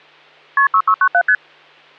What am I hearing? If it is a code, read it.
Multi-frequency trunk signalling (R1, as on North American trunks), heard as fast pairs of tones, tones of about 70 ms, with hum. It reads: KP 6697 ST